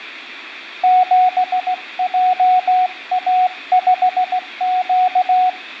Morse code, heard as a keyed tone, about 16 wpm, 740 Hz. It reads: 7JA5Q